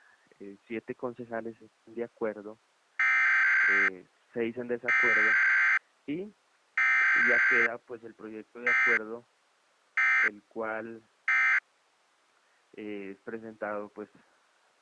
Emergency Alert System (SAME) tones (header bursts, then end-of-message bursts), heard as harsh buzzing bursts, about 520.83 baud.